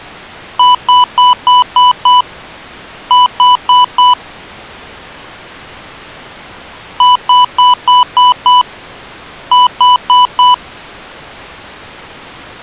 Beep code, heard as beeps from a small speaker, played twice, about 990 Hz. 6-4.